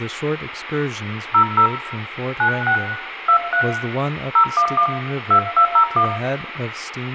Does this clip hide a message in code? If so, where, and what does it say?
Yes: DTMF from 1.3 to 6.0 s, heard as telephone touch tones, dialled by hand, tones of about 90 ms, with radio hiss, room echo and speech in English. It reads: 00 96 23 011 2201